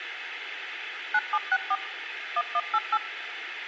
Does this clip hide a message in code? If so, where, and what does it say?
Yes: DTMF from 1.1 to 3.0 s, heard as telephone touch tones, dialled by machine, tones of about 50 ms, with radio hiss. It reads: 9764 1188